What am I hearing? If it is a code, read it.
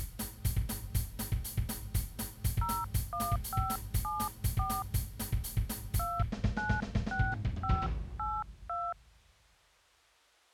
DTMF, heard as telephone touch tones, dialled by hand, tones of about 230 ms. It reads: 01574 296582